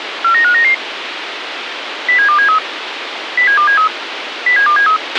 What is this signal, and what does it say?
Five-tone selective call (CCIR), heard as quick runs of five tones, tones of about 100 ms, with radio hiss and a squelch burst at the end. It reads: 49599 07273 07273 07273